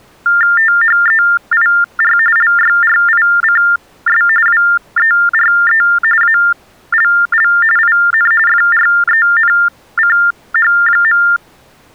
TTY/TDD text telephone tones (45.45 baud Baudot), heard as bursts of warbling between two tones, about 400 Hz shift, 1600 Hz centre. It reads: THEIR LYRICS WERE ALL IN FRENCH.